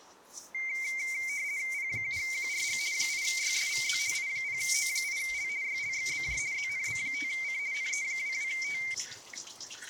RTTY (50 baud, 170 Hz shift), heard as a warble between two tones, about 2200 Hz centre, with kitchen noise. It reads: P7QRG 8YSVZ I0O8L YLXBJ ZNB5C NE22T